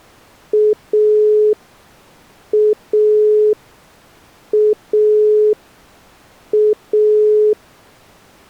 Telephone call progress tone (pulsed, as in Italy), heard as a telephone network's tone, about 420 Hz. Dial tone.